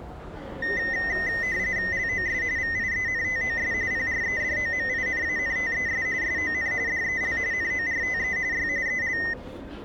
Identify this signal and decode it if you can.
RTTY (45.45 baud, 170 Hz shift), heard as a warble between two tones, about 1950 Hz centre, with the noise of a crowd indoors. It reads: LOS VIENTOS PREDOMINANTES SON DEL NORTE Y EL